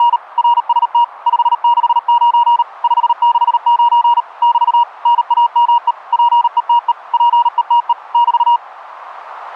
Morse code, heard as a keyed tone, machine-sent, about 38 wpm, 950 Hz. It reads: … RST 569 569 <BT> NAME PETE PETE <BT>